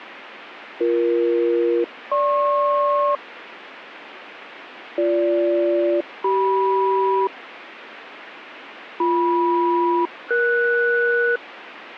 Aircraft SELCAL, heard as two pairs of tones, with radio static. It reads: BE-GP BG-CM BM-ES